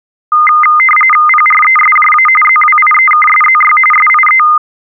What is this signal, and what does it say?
RTTY (45.45 baud, 850 Hz shift), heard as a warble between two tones, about 1650 Hz centre. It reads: PRESJA ZWIEKSZY SIE